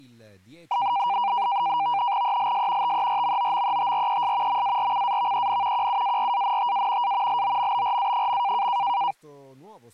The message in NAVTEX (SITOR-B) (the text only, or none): ELS TERMOMETRES MARCAVEN QUARANTA A LOMBRA.